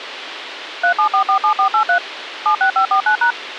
DTMF, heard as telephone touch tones, dialled by machine, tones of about 100 ms, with radio hiss. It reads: 37447483 76549#